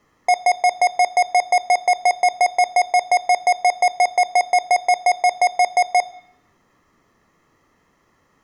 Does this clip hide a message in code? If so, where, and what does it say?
No, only evenly repeated beeps, with room echo.